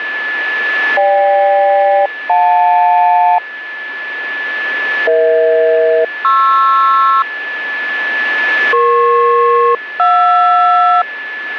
Aircraft SELCAL, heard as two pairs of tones, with radio static and a steady whistle near 1730 Hz. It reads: GK-JL EH-PR EP-JR